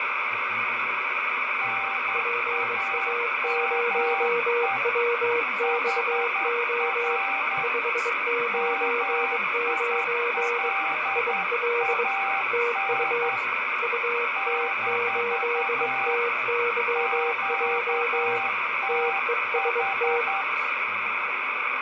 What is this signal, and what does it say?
Morse code, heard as two keyed tones, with heavy radio static, fading and speech in English. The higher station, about 10 wpm, 780 Hz: NAME HR MILAN - QTH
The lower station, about 22 wpm, 480 Hz: PA0WXO 599 IL TU UT8TYJ TEST